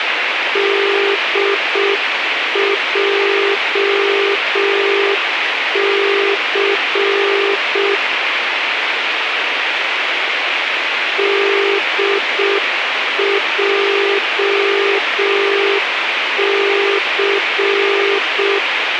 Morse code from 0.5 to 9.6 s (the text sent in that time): DJC